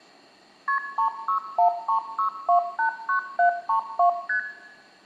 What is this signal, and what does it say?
Multi-frequency trunk signalling (R1, as on North American trunks), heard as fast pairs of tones, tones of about 100 ms, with room echo. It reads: KP 36136289732 ST